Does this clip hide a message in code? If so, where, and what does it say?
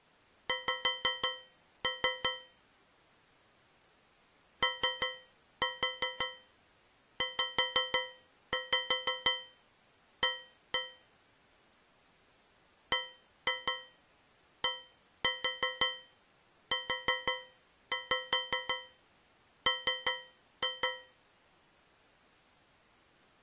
Yes: tap code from 0.5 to 21.3 s, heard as taps on a metal pipe, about 5 knocks a second. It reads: X OZA BDUM